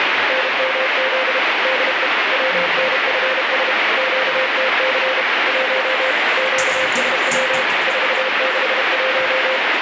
Morse code, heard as a keyed tone, machine-sent, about 32 wpm, 520 Hz, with heavy radio static and the noise inside a lift. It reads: NMZ DE WNFS QTC 1 QSW 461